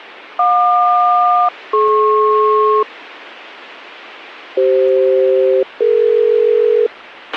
Aircraft SELCAL, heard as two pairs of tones, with a squelch burst at the end. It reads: JQ-DP CF-DE